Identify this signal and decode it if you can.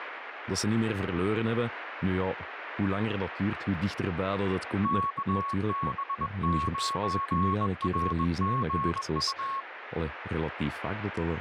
Morse code, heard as a keyed tone, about 21 wpm, 1100 Hz, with radio static and speech in Dutch. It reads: KB9RGU